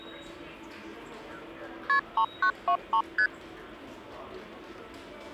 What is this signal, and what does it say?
Multi-frequency trunk signalling (R1, as on North American trunks), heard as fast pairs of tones, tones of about 80 ms, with the noise of a subway station. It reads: KP 3923 ST